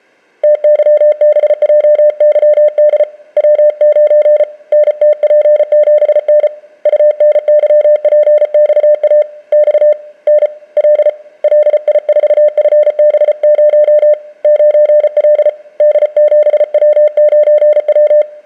Morse code, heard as a keyed tone, hand-sent with a paddle, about 34 wpm, 600 Hz. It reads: TYBJYD W9 NTP7N UNYPXA X N L LI4FB0 9L D7W9W